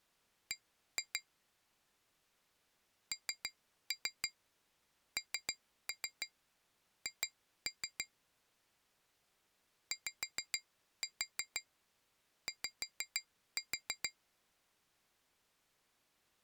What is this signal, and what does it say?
Tap code, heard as taps on glass, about 6 knocks a second. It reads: B NNH YY